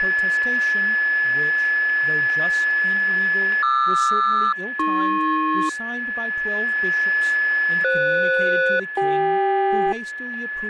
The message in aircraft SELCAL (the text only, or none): QR-AP FS-CK